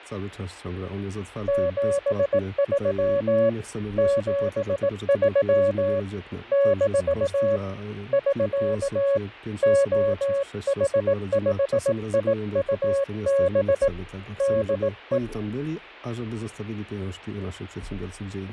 Morse code, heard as a keyed tone, hand-sent with a paddle, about 18 wpm, 560 Hz, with fading. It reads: 73 73 - <SK> OH5IUB DE